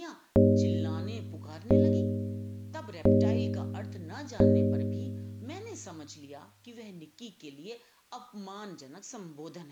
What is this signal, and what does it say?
Clock strike, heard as a bell, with speech in Hindi. 4. Four o'clock.